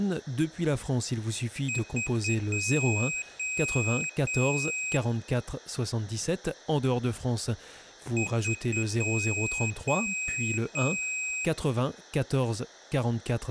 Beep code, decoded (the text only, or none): 3 short, 3 long